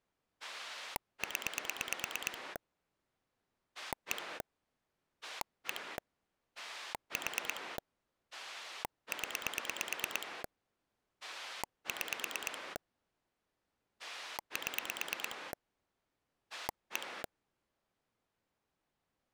Pulse dialling, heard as a rotary dial, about 9 pulses a second. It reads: 0 1 1 4 0 6 7 1